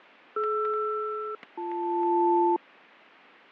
Aircraft SELCAL, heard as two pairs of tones, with fading and static crashes. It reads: DR-BL